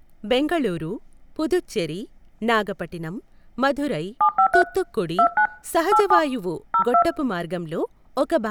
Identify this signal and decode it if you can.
DTMF, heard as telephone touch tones, dialled by hand, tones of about 80 ms, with speech in Telugu. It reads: 753 29 87 02